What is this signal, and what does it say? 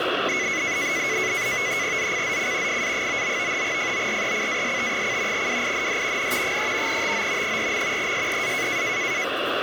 NAVTEX (SITOR-B), 100 baud, 170 Hz shift, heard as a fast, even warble, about 2100 Hz centre, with radio static and the noise of a crowd indoors. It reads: ZCZC FA99 FORECAST: WIND N 3 TO 4. SEA